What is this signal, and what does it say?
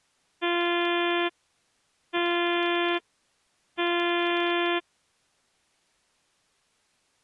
Ship horn signal, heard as a ship's horn, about 350 Hz. 3 short. At sea: I am operating astern propulsion.